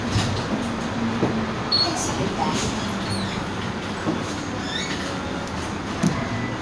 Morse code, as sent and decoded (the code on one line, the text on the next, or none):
none